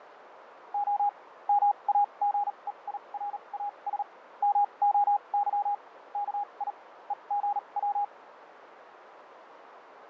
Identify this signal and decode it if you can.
Morse code (Greek alphabet), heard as a keyed tone, machine-sent, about 38 wpm, spaced as for 29 wpm, 820 Hz, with radio static and fading. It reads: Ο ΜΑΓΕΙΡΑΣ ΜΟΥ ΚΙ ΕΓΩ